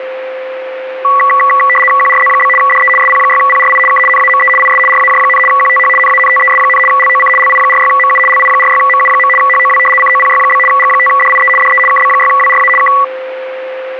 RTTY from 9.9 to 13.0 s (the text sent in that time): COPY? G5DIE DE KB6WRA K